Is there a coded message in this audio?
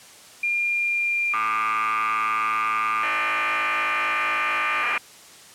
Yes: cassette data (Kansas City type), 1200 baud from 0.4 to 5.0 s, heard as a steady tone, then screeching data.